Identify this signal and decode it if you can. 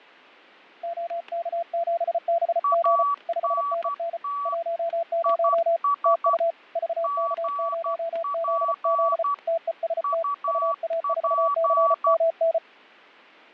Morse code, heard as two keyed tones, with fading and static crashes. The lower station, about 34 wpm, 670 Hz: OK7BG 5NN 10 TU VK0ZZ TEST UA4CMN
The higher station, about 12 wpm, 1140 Hz: ANT IS GP UP